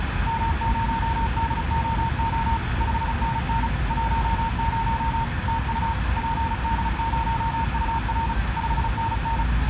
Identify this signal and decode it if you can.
Morse code, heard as two keyed tones, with radio static and the noise of a residential street. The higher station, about 35 wpm, 910 Hz: M0DOO 5NN 10 TU PD0UR 5NN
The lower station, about 19 wpm, 510 Hz: CQ CQ CQ QRP